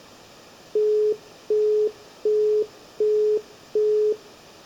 Telephone call progress tone (as in the UK, Australia and similar networks), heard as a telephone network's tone, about 420 Hz, 0.375 s on and 0.375 s off, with room echo. Busy tone.